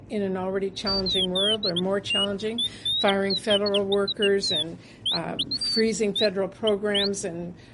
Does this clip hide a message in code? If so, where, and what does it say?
No, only bird-like chirps.